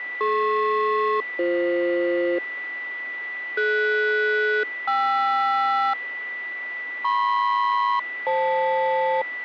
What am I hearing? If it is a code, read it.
Aircraft SELCAL, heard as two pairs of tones, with a steady whistle near 1970 Hz. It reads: DP-BF DS-KR MP-FL